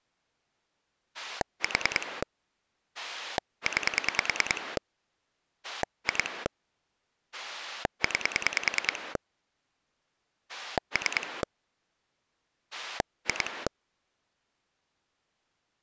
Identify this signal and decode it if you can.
Pulse dialling, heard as a rotary dial, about 10 pulses a second. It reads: 4 9 2 9 3 2